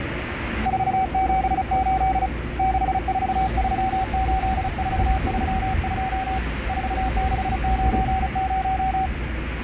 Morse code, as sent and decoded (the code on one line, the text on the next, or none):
....- --... ---.. / -.... ....- ...-- ---.. ....- ...-- ..--- / ....- -.... ----. -----
478 6438432 4690